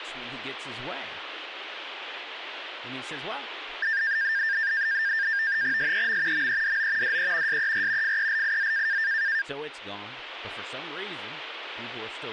NAVTEX (SITOR-B), 100 baud, 170 Hz shift, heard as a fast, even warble, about 1700 Hz centre, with speech in English. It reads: SEM MEDO DE SER FELIZ